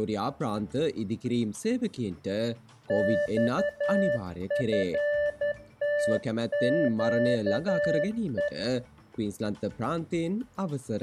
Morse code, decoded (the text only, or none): XFTQE